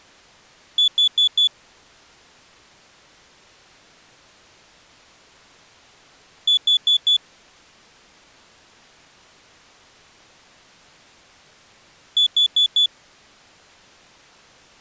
Alarm pattern, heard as an alarm's beeps, played three times, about 3450 Hz. Temporal four. Carbon monoxide.